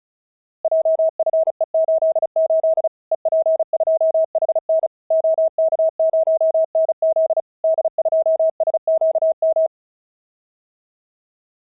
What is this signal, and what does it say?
Morse code, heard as a keyed tone, machine-sent, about 35 wpm, 640 Hz. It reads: JFE88 EP2HN OK0NZ D2SQM